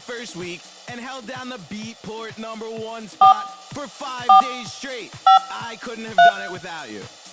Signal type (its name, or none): DTMF